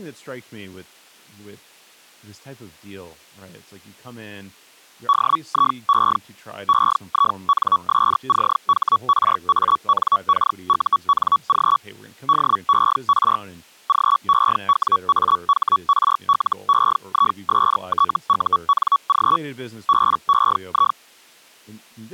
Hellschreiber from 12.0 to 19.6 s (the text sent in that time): DER GEWAHRLEISTUNG